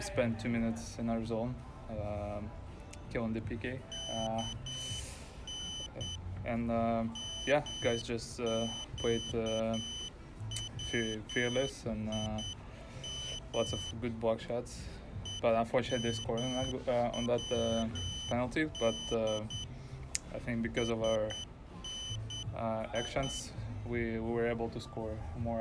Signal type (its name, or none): Morse code